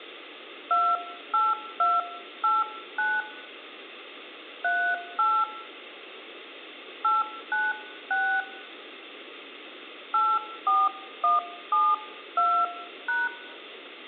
DTMF, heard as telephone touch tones, dialled by hand, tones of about 230 ms. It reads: 28289 38 896 84172#